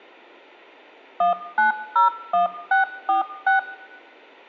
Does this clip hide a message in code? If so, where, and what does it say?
Yes: DTMF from 1.2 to 3.6 s, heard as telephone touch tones, dialled by machine, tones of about 130 ms. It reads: 1901646